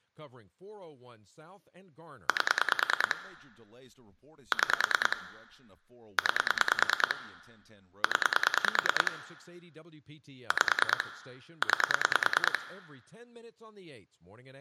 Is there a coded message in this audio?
Yes: pulse dialling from 2.3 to 12.6 s, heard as clicks on a phone line, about 9 pulses a second, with room echo and speech in English. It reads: 8 6 9 0 5 9